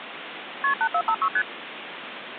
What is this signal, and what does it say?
Multi-frequency trunk signalling (R1, as on North American trunks), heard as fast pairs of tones, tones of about 70 ms, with phone line noise. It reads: KP 8456 ST